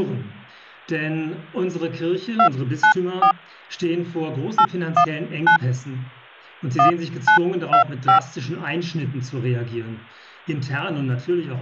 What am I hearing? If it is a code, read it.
DTMF, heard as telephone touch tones, dialled by hand, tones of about 100 ms. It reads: 294 819 1925